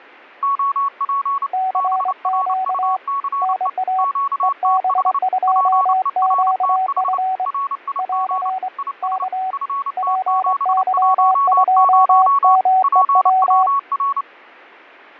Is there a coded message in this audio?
Yes: Morse code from 0.4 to 14.3 s, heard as two keyed tones, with fading. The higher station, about 29 wpm, 1110 Hz: OP BRUCE QTH PERTH RIG IS FT710 PWR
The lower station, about 24 wpm, 750 Hz: CQ NA EB2QF <AR> K PY2MEW